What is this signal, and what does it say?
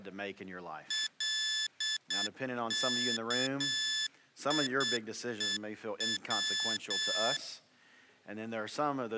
Morse code, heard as electronic beeps, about 8 wpm, 1750 Hz. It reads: LKIEW